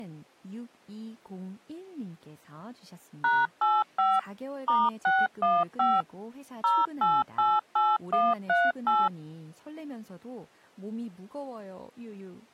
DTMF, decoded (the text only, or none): #85 *615 0888138